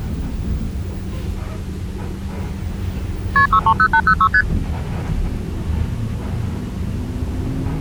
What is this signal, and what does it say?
Multi-frequency trunk signalling (R1, as on North American trunks), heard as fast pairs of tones, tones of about 70 ms, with the noise inside a bus. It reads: KP 630806 ST